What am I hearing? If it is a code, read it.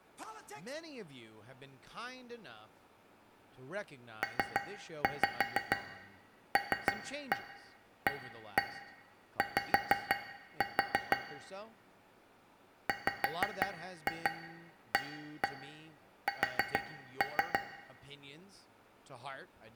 Tap code, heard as taps on a metal pipe, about 6 knocks a second, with room echo and speech in English. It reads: PLAY WAS